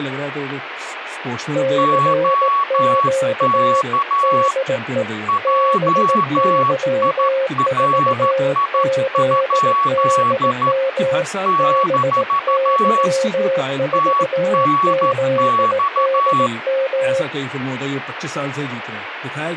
Morse code, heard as two keyed tones, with radio static and speech in Hindi. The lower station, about 18 wpm, 530 Hz: CQ DE BY4ZDM BY4ZDM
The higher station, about 13 wpm, 1120 Hz: OK JIRI? - TNX